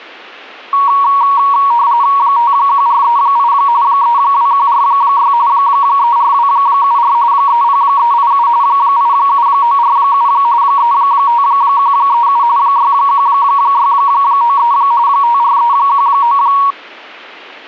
RTTY (45.45 baud, 170 Hz shift), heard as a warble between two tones, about 1030 Hz centre. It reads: 51438 32146 34274 30387 87947 35137 61693 54319